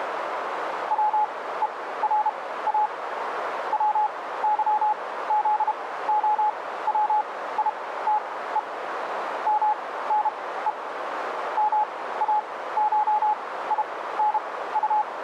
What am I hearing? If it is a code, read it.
Morse code (Russian alphabet), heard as a keyed tone, machine-sent, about 32 wpm, spaced as for 17 wpm, 850 Hz, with radio static and a narrow filter. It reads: ВЕРА ВЫЗОВИТЕ МНЕ МАШИНУ